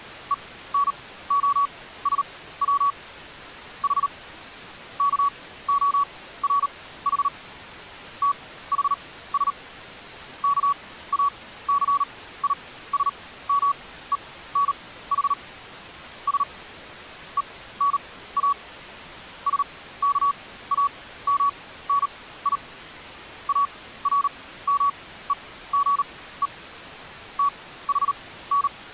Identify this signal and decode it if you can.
Morse code (Greek alphabet), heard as a keyed tone, machine-sent, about 38 wpm, spaced as for 17 wpm, 1130 Hz. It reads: ΕΝΟΣΩ Η ΚΟΡΗ ΤΗΣ ΚΑΘΙΣΜΕΝΗ Σ ΕΝΑ ΣΚΑΜΝΙ ΑΡΜΕΓΕ ΤΗΝ